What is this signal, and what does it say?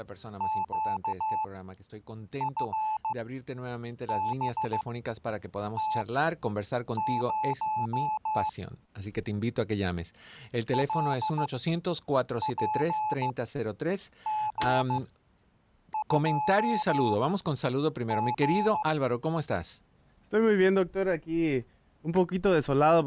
Morse code, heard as a keyed tone, machine-sent, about 15 wpm, spaced as for 7 wpm, 860 Hz. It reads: QFBT0 LPG2G